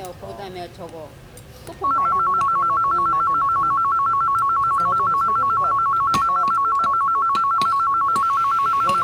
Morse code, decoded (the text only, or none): none